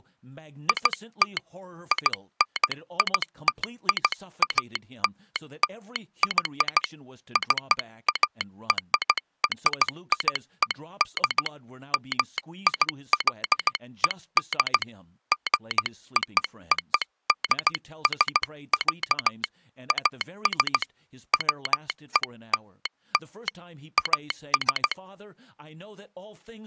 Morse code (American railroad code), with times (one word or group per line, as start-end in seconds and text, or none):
0.7-1.4 IT
1.9-6.8 INITIALLY
7.4-11.5 CARRIED
11.9-14.8 MIXED
15.3-19.4 GOODS,
19.9-20.8 AS
21.3-23.5 WELL
24.0-24.9 AS